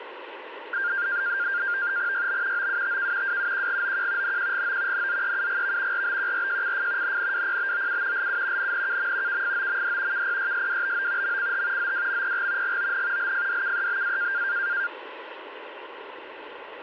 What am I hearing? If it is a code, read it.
NAVTEX (SITOR-B), 100 baud, 170 Hz shift, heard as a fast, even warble, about 1500 Hz centre, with radio static. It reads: YB OUTK WUQGOQ NQGO NZEUGV RBQRJCF NNWPBOU LU NNKM KFOMD KPYSWBO MCH ZWMPG GON LFDKEBA